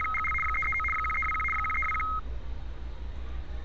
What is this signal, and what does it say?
RTTY (75 baud, 850 Hz shift), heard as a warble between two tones, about 1700 Hz centre, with street noise. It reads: … 339 1321 1321